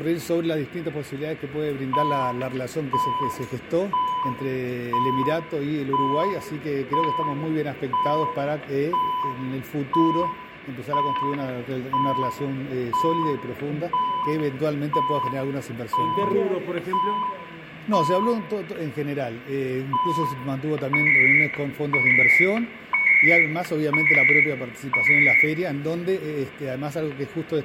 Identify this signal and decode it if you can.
Radio time signal (CHU, Canada), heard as beeps and data bursts, one a second, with static crashes and room echo.